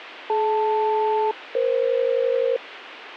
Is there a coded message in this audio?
Yes: aircraft SELCAL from 0.3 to 2.6 s, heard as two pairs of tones, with radio hiss. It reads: DL-EF